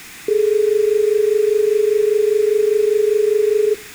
Telephone call progress tone (as in Australia), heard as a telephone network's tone, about 430 Hz, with room echo. Dial tone.